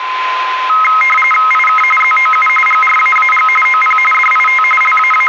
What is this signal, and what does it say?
RTTY (45.45 baud, 850 Hz shift), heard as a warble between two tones, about 1700 Hz centre, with radio static and a steady whistle near 1030 Hz. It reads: IK ZOU GRAAG OP DIT …